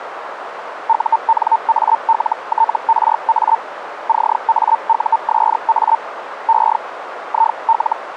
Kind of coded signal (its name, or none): Hellschreiber